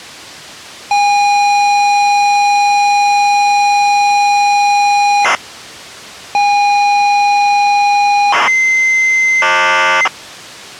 ZX Spectrum tape loading, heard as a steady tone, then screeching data.